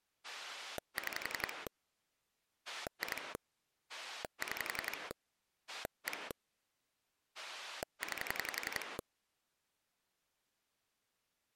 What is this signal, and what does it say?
Pulse dialling, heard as a rotary dial, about 11 pulses a second. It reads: 6 2 6 1 9